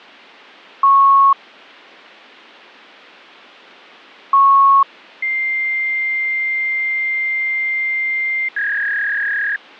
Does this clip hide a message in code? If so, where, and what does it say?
Yes: fax machine handshake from 0.8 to 9.6 s, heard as beeps, a long tone and a warble.